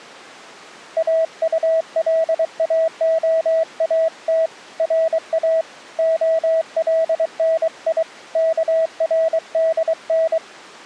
Morse code (Persian alphabet), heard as a keyed tone, hand-sent with a paddle, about 23 wpm, 650 Hz. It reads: اطلاعات را علنی کردن